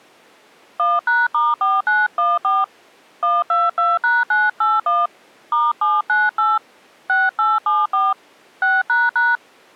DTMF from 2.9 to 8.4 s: 122#981 *798 6874

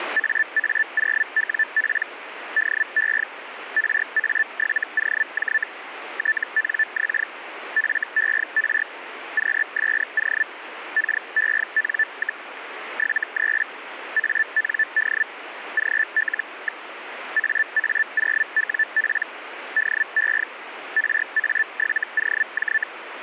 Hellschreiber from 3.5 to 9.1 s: RA7OJ TNX FER

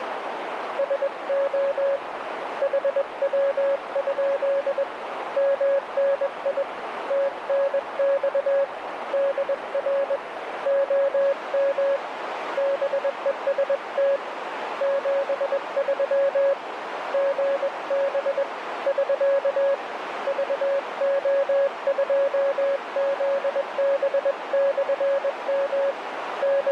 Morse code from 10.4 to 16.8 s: OM BEST 73

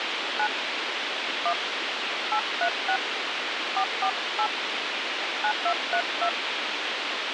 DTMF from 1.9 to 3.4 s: 836

